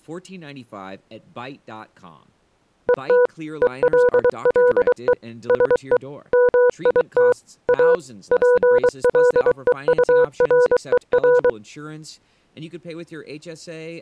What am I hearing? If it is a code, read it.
Morse code, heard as a keyed tone, machine-sent, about 23 wpm, 490 Hz, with speech in English. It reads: ET ELLE SE MIT A PLEURER